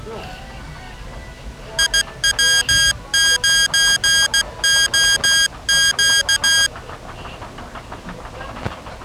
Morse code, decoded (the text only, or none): IW9OQ